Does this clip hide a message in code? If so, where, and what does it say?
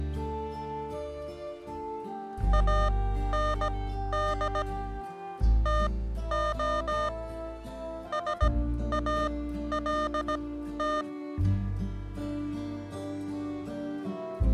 Yes: Morse code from 2.5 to 11.1 s, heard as electronic beeps, machine-sent, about 17 wpm, spaced as for 12 wpm, 610 Hz. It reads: AND TO SALT